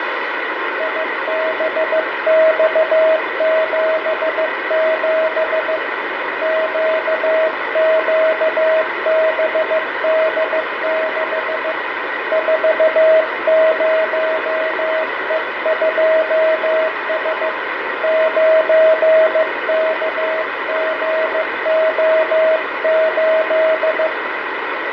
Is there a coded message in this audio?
Yes: Morse code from 0.7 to 24.1 s, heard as a keyed tone, hand-sent with a paddle, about 15 wpm, 640 Hz, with heavy radio static, fading and room echo. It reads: IBX77 QQBD6 40E2S 9KGO8